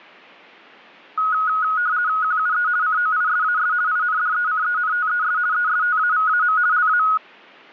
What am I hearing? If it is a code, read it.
RTTY (50 baud, 170 Hz shift), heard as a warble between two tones, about 1360 Hz centre. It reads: QUE COISAS INDECENTES ESTAVAM LA